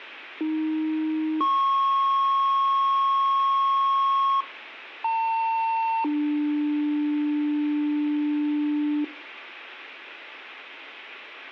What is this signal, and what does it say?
Two-tone page, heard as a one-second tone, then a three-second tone, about 310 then 1090 Hz, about 900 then 300 Hz, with room echo.